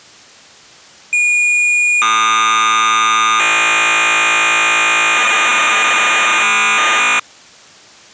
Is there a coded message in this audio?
Yes: cassette data (Kansas City type), 1200 baud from 1.1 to 7.2 s, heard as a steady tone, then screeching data.